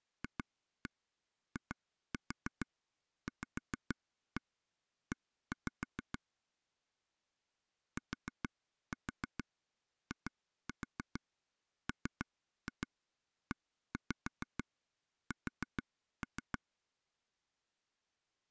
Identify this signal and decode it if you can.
Tap code, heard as taps on a table, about 6 knocks a second. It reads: FIVE TIMES